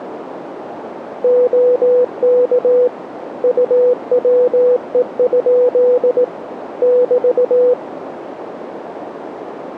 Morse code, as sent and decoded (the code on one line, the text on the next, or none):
--- -.- / ..- .-- . ..--.. / -...-
OK UWE? <BT>